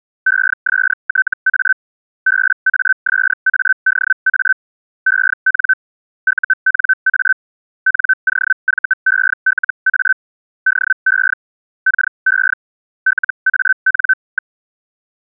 Hellschreiber (Feld-Hell, 122.5 baud), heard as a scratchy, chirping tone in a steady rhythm, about 1550 Hz. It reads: ESTA BASADA EN UNA NOVELA DE KE LAN.